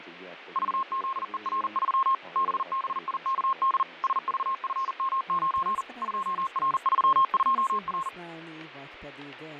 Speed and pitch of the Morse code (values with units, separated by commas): 40 wpm, 1070 Hz